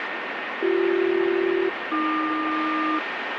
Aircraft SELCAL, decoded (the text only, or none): BC-AQ